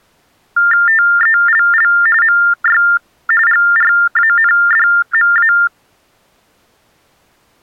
TTY/TDD text telephone tones (45.45 baud Baudot), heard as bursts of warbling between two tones, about 400 Hz shift, 1600 Hz centre. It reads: TELL MY GRANDMA